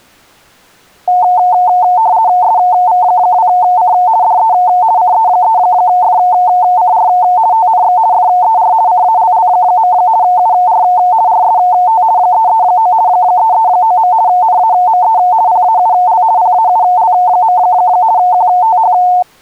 RTTY (50 baud, 170 Hz shift), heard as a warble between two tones, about 810 Hz centre. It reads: SV2C DE CE3FCR TNX FER CALL. UR RST 339 339. NAME PAUL PAUL. QTH